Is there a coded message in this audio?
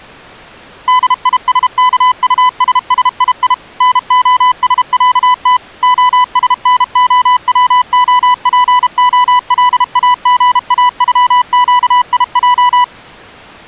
Yes: Morse code (Russian alphabet) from 0.8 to 12.9 s, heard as a keyed tone, machine-sent, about 32 wpm, 1000 Hz. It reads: ДИСКУССИИ НОСЯТ ОСНОВОПОЛАГАЮЩИЙ